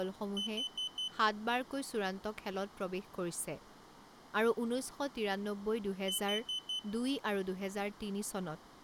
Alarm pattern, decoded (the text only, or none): temporal four